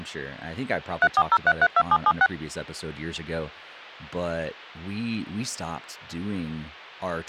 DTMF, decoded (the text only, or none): 340332776